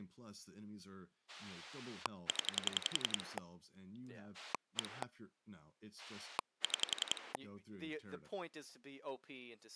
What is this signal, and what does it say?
Pulse dialling, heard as a rotary dial, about 11 pulses a second, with speech in English. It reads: 0 1 6